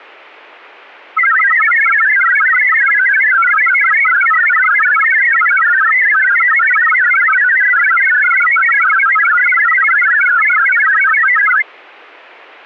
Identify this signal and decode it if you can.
Multi-tone FSK (Olivia or MFSK type), about 1000 Hz wide, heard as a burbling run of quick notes, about 62.5 baud.